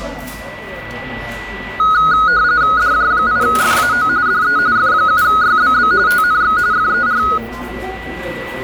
RTTY (45.45 baud, 170 Hz shift), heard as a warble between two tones, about 1360 Hz centre, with a steady whistle near 1960 Hz and the noise of a crowd indoors. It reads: DJ8FAO DE F7YBB TNX FER